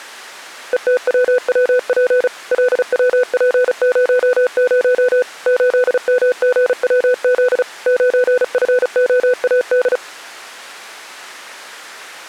Morse code, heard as a keyed tone, machine-sent, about 35 wpm, 500 Hz. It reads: ETWWP LWP00 8MGWZ 9FOAD